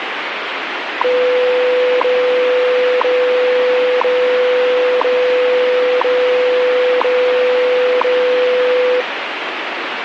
Radio time signal (WWV, Colorado), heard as ticks, one a second, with radio static.